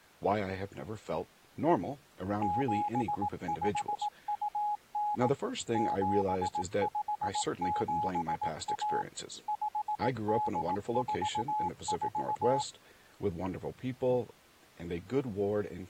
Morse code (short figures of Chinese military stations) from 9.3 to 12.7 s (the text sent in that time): 5844